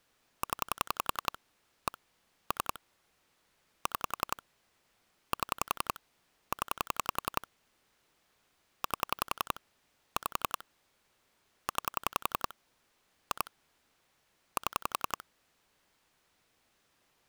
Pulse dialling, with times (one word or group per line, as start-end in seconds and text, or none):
0.4-1.4 0
1.9-2.0 1
2.5-2.8 3
3.9-4.4 6
5.3-6.0 7
6.5-7.5 0
8.8-9.6 8
10.2-10.6 5
11.7-12.5 9
13.3-13.5 2
14.6-15.2 7